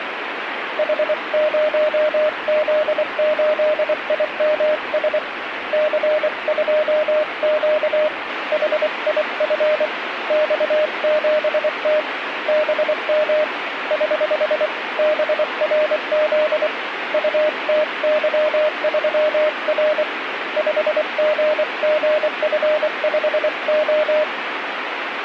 Morse code, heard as a keyed tone, hand-sent with a paddle, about 24 wpm, 610 Hz, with radio static. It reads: H0Z8IMS C2Q HIF X7T BM <HH> BRZ UTY3R 5GGF5O